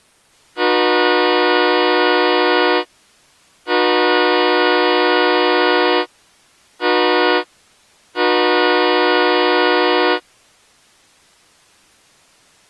Train horn signal, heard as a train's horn. 2 long, 1 short, 1 long. On North American railways: approaching a public crossing.